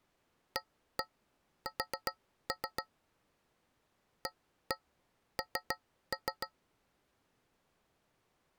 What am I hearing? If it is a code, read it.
Tap code, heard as taps on a metal pipe, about 6 knocks a second. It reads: AS AN